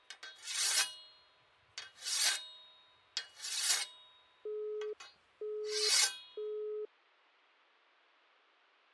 Telephone call progress tone (single-tone plan, as in Europe, Japan and elsewhere), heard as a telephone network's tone, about 420 Hz, 0.48 s on and 0.48 s off. Busy tone.